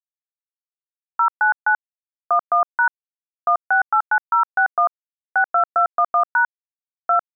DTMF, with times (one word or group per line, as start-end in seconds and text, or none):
1.2-1.8 099
2.3-2.9 11#
3.5-4.9 1689061
5.4-6.4 62211#
7.1-7.2 2